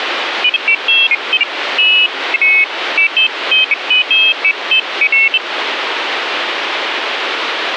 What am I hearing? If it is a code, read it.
Pairs of high tones at irregular times, with radio static. There is no code.